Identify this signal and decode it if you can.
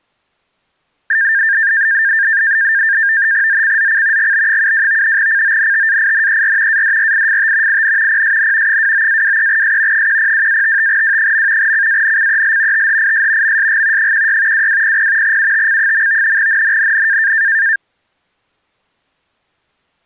NAVTEX (SITOR-B), 100 baud, 170 Hz shift, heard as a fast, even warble, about 1700 Hz centre. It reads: ZCZC GB72 CONTAINER ADRIFT IN PSN 29-23S 102-55W. CANCEL THIS MSG 16 2200 UTC. NNNN